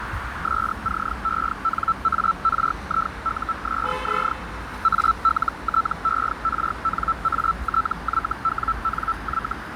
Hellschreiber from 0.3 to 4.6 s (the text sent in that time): SCENARIUSZ